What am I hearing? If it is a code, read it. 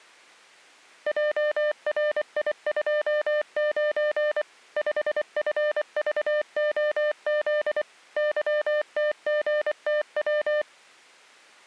Morse code, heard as a keyed tone, machine-sent, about 24 wpm, 600 Hz. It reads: JRI29 5FVOZ YTGTW